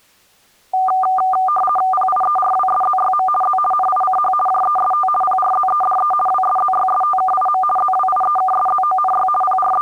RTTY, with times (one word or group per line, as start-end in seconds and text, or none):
1.9-3.3 PIERWSZYM
3.4-3.6 Z
3.7-4.3 NICH
4.5-5.1 JEST
5.2-6.1 PRZEDE
6.3-7.6 WSZYSTKIM
7.8-9.3 ZWIEKSZONY
9.4-9.8 …